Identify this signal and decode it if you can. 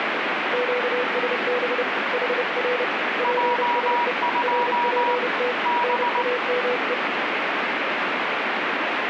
Morse code, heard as two keyed tones, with heavy radio static. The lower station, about 30 wpm, 490 Hz: QSB HR PSE RPT NAME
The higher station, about 19 wpm, 960 Hz: J2 B